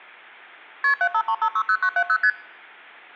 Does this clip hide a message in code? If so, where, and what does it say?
Yes: multi-frequency trunk signalling (R1, as on North American trunks) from 0.8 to 2.3 s, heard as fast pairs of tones, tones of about 70 ms. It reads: KP 753560970 ST